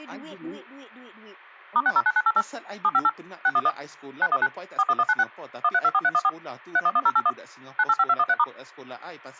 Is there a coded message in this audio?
Yes: DTMF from 1.8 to 8.4 s, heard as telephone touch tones, dialled by machine, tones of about 50 ms, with a squelch burst at the end and speech in Malay. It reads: *609988 758 611 919 41196 1324314 311081 985213*